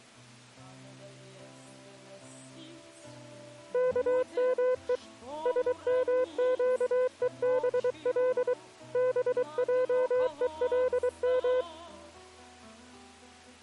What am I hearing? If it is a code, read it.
Morse code (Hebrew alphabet), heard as a keyed tone, hand-sent with a paddle, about 23 wpm, 510 Hz. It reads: כמו שמקובל בעולם